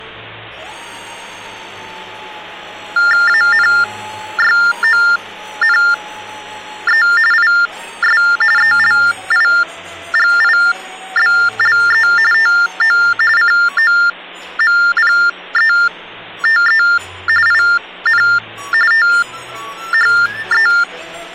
TTY/TDD text telephone tones (45.45 baud Baudot), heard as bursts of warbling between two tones, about 400 Hz shift, 1600 Hz centre, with hum. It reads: ANYONE IS ELIGIBLE TO COMPETE IN THE